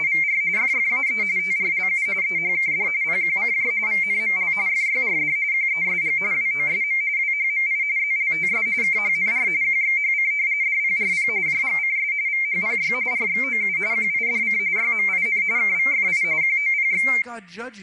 RTTY (45.45 baud, 170 Hz shift), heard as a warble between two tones, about 2200 Hz centre, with speech in English. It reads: … FFAE TRLU EHKD PQCJ VNML FYRD QESG WOSM WHMI ZLTS KHNR QXHC DPRP JGCS VHPY RXOU QIDC YMIN KVFI QOPX